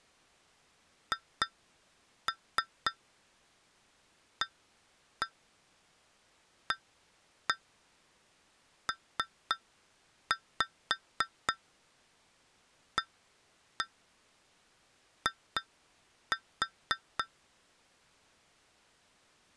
Tap code, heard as taps on glass, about 3 knocks a second. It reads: HAAPAI